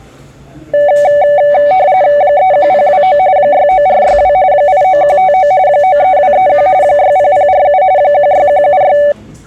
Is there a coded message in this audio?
Yes: RTTY (45.45 baud, 170 Hz shift) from 0.7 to 9.1 s, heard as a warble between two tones, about 670 Hz centre, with the noise of a cafe. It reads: 31029 69462 89159 93231 60047 16176